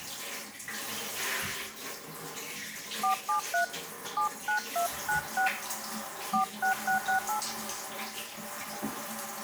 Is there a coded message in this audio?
Yes: DTMF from 3.0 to 7.4 s, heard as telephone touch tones, dialled by hand, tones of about 110 ms, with the noise of a restroom. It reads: 473 79296 46668